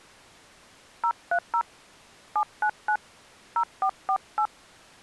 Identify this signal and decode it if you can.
DTMF, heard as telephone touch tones, dialled by hand, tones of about 70 ms. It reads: 030 799 0448